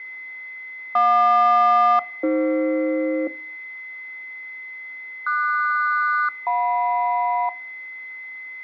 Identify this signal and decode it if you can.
Aircraft SELCAL, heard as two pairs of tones, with fading and a steady whistle near 2040 Hz. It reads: JQ-AF QS-JM